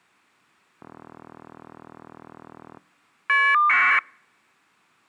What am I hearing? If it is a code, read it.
Caller ID data burst, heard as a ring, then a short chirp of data, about 1200 baud.